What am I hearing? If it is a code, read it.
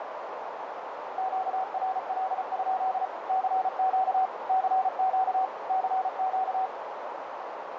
Morse code, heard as a keyed tone, machine-sent, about 34 wpm, 760 Hz, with radio static and a narrow filter. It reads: QRL? CQ CQ CQ